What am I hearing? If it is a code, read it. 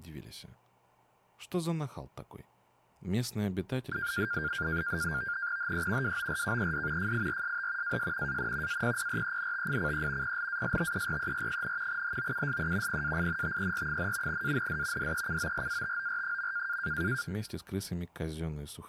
NAVTEX (SITOR-B), 100 baud, 170 Hz shift, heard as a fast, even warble, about 1500 Hz centre. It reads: HE WORKED FIRST AS AN APPRENTICE PLASTERER, HOUSE PAINTER, AND DECORATOR.